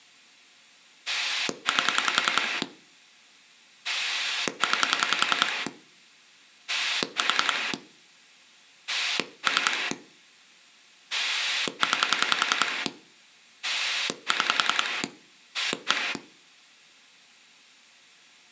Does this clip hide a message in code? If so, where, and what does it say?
Yes: pulse dialling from 1.1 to 16.2 s, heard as a rotary dial, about 10 pulses a second, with room echo. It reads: 8 9 4 3 9 6 1